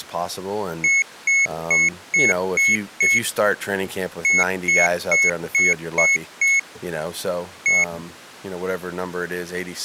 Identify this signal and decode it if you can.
Beep code, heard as a piezo beeper, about 2200 Hz, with speech in English. 6-6-1.